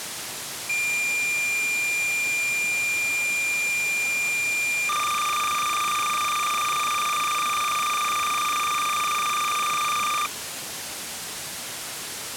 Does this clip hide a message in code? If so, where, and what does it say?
Yes: cassette data (Kansas City type), 300 baud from 0.7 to 10.3 s, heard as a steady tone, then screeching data, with tape hiss.